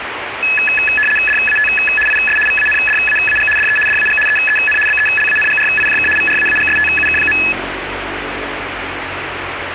RTTY (75 baud, 850 Hz shift), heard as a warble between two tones, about 2150 Hz centre, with radio static and street noise. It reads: DAT IS VANDAAG DE DAG EEN BELANGRIJK VRAAGSTUK.